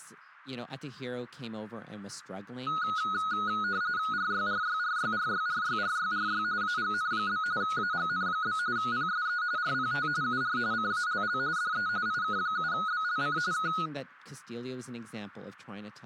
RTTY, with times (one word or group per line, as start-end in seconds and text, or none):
4.1-6.4 RYRYRYRYRYRYRY
6.6-7.4 AGN?
7.6-8.6 AGN?
8.8-9.4 PSE
9.6-10.1 RPT
10.2-10.6 UR
10.7-11.4 CALL
11.6-11.9 DE
12.1-13.4 IK7BLC
13.5-13.7 K